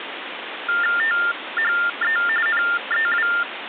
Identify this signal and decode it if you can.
TTY/TDD text telephone tones (45.45 baud Baudot), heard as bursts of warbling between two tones, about 400 Hz shift, 1600 Hz centre, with phone line noise. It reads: THE NEW